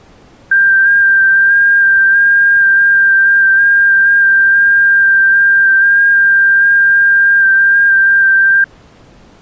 FT8 (one signal), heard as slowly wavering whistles, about 6.25 baud.